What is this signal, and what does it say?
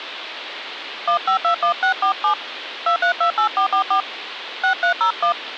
DTMF, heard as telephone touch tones, dialled by hand, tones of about 100 ms, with phone line noise. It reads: 1521647 2328444 6301